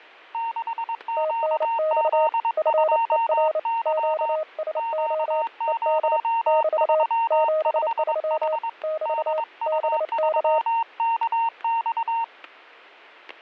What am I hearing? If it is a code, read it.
Morse code, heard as two keyed tones, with static crashes. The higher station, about 22 wpm, 920 Hz: 6QZ2Y Q035H DU3KX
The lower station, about 29 wpm, 620 Hz: TNX FER QSO ED <BT> 73 <BT> BK